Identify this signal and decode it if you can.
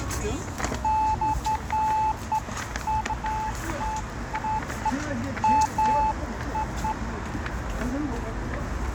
Beeps of irregular length, with radio static, fading, a narrow filter and street noise. There is no code.